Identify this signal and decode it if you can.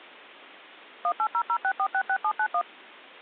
DTMF, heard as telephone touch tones, dialled by machine, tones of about 70 ms. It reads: 18006466791